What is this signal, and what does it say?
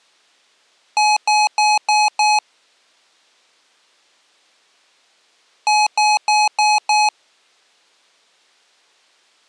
Beep code, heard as beeps from a small speaker, played twice, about 840 Hz. 5 short. In AMI BIOS tables: processor failure; in Dell tables: CMOS battery failure.